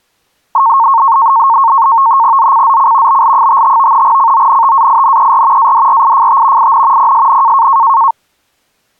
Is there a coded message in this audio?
Yes: NAVTEX (SITOR-B), 100 baud, 170 Hz shift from 0.5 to 8.1 s, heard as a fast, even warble, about 1000 Hz centre. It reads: ZCZC BL55 CONTAINER ADRIFT IN PSN